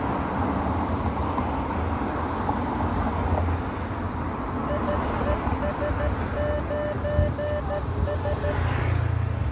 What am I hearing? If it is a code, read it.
Morse code, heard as a keyed tone, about 13 wpm, 590 Hz, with street noise. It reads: IES9S